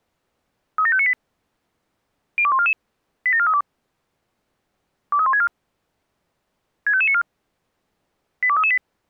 Five-tone selective call (ZVEI), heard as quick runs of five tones, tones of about 70 ms. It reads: 37598 02144 87432 23164 65594 82338